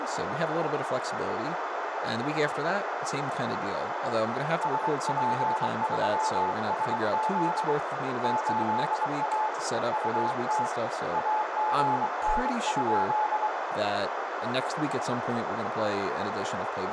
Morse code, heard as a keyed tone, hand-sent with a paddle, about 23 wpm, 860 Hz, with heavy radio static, a narrow filter and speech in English. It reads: SP3SZ 8A UT AGN?